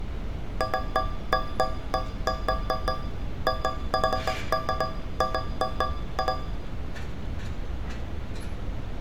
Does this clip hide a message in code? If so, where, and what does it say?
No, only irregular taps on a metal pipe, with room echo and street noise.